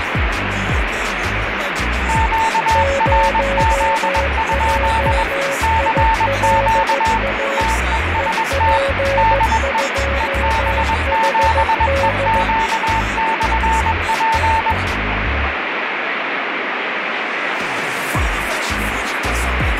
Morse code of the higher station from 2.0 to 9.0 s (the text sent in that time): QRZ? CQ TEST